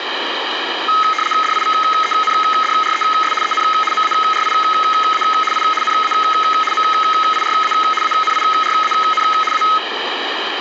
RTTY (75 baud, 850 Hz shift), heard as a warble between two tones, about 1700 Hz centre, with radio static. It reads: DIVENDRES EN MARIA I NA MIRA ANIRAN A